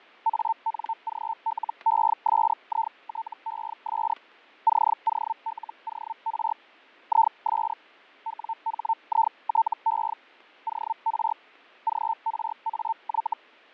Hellschreiber (Feld-Hell, 122.5 baud), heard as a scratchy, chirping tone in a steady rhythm, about 900 Hz, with fading and static crashes. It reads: ANGLESITES COLOR IS WHITE OR GRAY